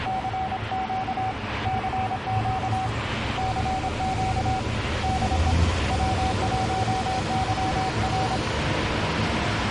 Morse code, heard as a keyed tone, hand-sent with a paddle, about 26 wpm, 760 Hz, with radio static and the noise of a residential street. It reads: CQ CQ CQ DE W1YR